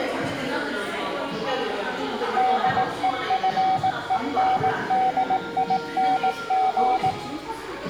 Morse code, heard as a keyed tone, machine-sent, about 18 wpm, 760 Hz, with room echo and the noise of a crowd indoors. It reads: DEFENDING